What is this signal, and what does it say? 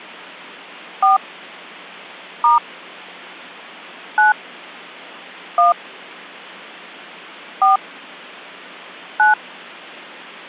DTMF, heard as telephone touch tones, dialled by hand, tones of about 140 ms. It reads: 4 * 9 1 4 9